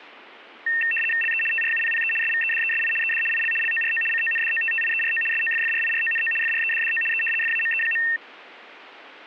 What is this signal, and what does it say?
RTTY (75 baud, 850 Hz shift), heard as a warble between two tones, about 2250 Hz centre. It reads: LE TRUPPE SVEDESI ED IL LORO CONDOTTIERO SOFFRIRONO FREDDO E FAME.